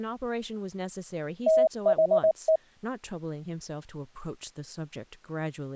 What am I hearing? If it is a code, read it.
Morse code, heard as a keyed tone, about 19 wpm, 640 Hz, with speech in English. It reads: THE